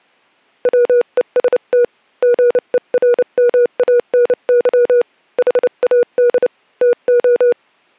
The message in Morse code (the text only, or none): WEST GERMANY HAD TO